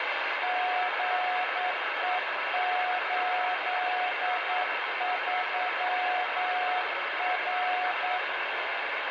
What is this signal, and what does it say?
Morse code, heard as two keyed tones, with heavy radio static. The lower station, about 9 wpm, 730 Hz: GE83R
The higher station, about 24 wpm, 1310 Hz: QRL? CQ SOTA